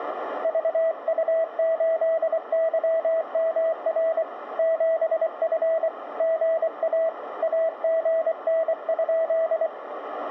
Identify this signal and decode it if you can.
Morse code, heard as a keyed tone, hand-sent with a paddle, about 24 wpm, 650 Hz, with radio static and a narrow filter. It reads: VU8YMR 7F GA AGN?